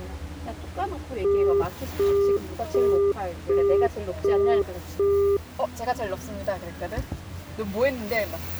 Telephone call progress tone (as in the UK, Australia and similar networks), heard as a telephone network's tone, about 400 Hz, 0.375 s on and 0.375 s off, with the noise inside a car. Busy tone.